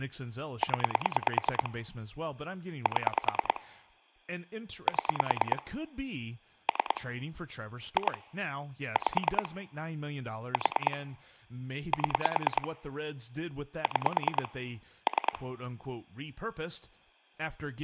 Pulse dialling, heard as clicks on a phone line, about 9 pulses a second, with speech in English. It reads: 0 7 7 3 2 5 4 7 6 3